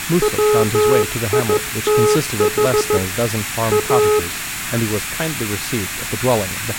Morse code, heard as a keyed tone, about 14 wpm, 420 Hz, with room echo and speech in English. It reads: WITH A